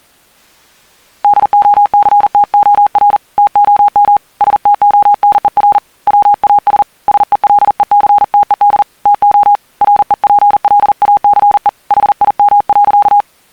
Morse code, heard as a keyed tone, hand-sent with a paddle, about 40 wpm, 820 Hz. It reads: DOCTOR TOM STONER WAS SELECTED TO REPLACE HIM.